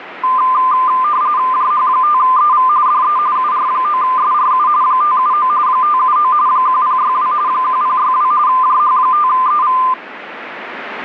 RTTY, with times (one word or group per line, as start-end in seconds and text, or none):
1.5-2.7 JH5EV
2.9-3.2 DE
3.4-4.7 UR9SRU
4.8-5.5 579
5.7-6.3 579
6.5-7.3 1062
7.5-8.3 1062
8.5-9.8 JH5EV